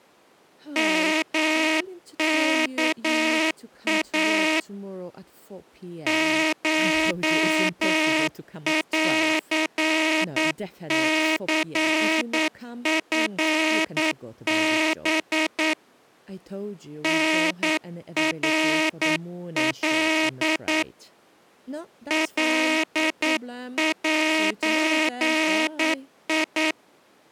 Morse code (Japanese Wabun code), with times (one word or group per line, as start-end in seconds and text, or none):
0.8-4.6 ヨワイ
6.1-15.7 コンニチハ
17.0-20.8 タナカ
22.1-26.7 カゼ